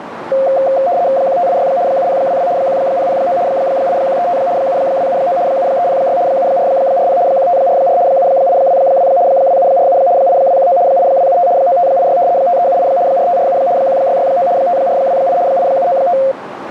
RTTY (75 baud, 170 Hz shift), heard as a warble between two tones, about 620 Hz centre, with radio static and a narrow filter. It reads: 1586 7022 1009 8135 7279 7306 7440 1544 7822 2747 8219 8275 9586 5378 4547 1669 5428 8795